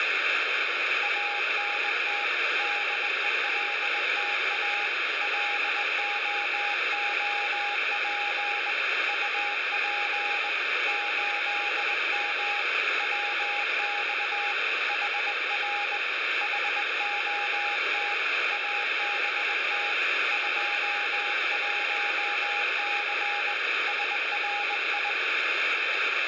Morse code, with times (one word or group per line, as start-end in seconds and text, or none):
1.0-2.2 ANT
2.6-4.9 DELTA
5.2-8.7 LOOP
9.1-10.5 UP
10.9-12.6 8M
13.0-14.5 WX
14.9-16.0 HR
16.4-18.1 HOT
18.5-19.9 ABT
20.3-23.5 21C
23.9-25.1 SRI